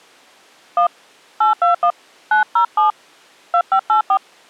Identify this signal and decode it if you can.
DTMF, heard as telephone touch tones, dialled by hand, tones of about 110 ms. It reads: 1 821 907 2584